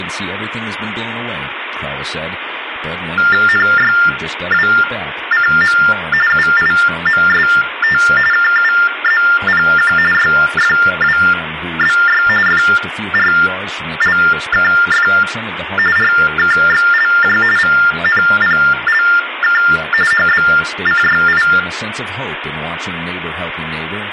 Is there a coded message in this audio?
Yes: TTY/TDD text telephone tones (45.45 baud Baudot) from 3.2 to 21.6 s, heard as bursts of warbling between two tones, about 400 Hz shift, 1600 Hz centre, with phone line noise, room echo and speech in English. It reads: NYWCM UIMST KUZPQ YFWBY FRLKF RKXLJ VNPLK HBCYI